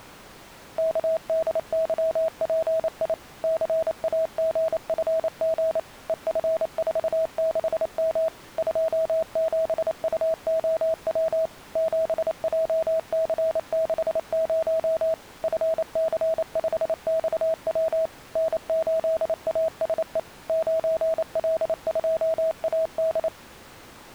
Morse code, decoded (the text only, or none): KDYPI CAGFG EF46M 27UOW 7JC60 FC5XW N8ASE 9L2AD